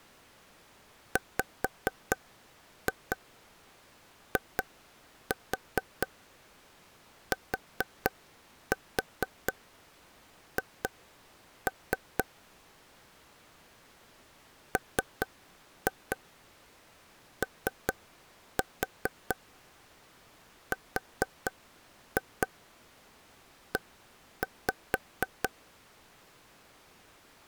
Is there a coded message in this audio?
Yes: tap code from 1.2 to 25.5 s, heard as taps on a table, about 4 knocks a second. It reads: WITH MORE